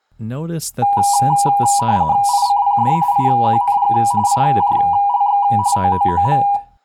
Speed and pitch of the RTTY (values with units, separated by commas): 45.45 baud, 170 Hz shift, 890 Hz centre